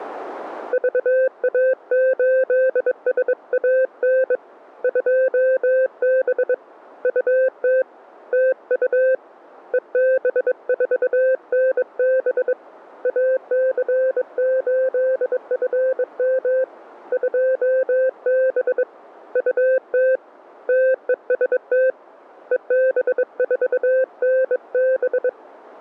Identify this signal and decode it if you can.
Morse code, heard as a keyed tone, hand-sent with a bug key, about 22 wpm, 520 Hz. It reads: VA8SAN 2B UT TU EB4NB AC8FM 2B UT TEST EB4NB